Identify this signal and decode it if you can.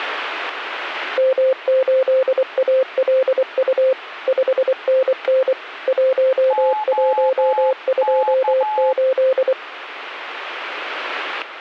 Morse code, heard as two keyed tones. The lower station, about 24 wpm, 520 Hz: M8ALU 5NN 1128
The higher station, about 12 wpm, 860 Hz: OK